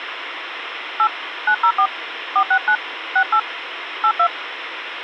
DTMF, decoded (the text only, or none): 8 904 469 68 82